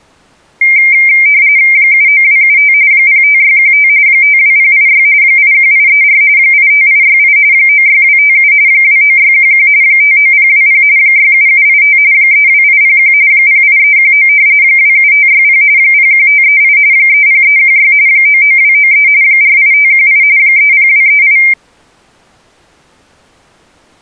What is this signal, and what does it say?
RTTY (45.45 baud, 170 Hz shift), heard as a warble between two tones, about 2200 Hz centre. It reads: 79275 05615 52086 81834 85868 96257 29611 59020 67785 32801 08319 27560 01538 30316 99293 48518 30238